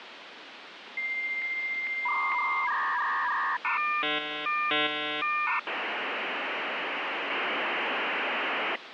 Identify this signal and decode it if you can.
Dial-up modem handshake (V.34 or later), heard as a whistle, warbles, then hiss, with phone line noise.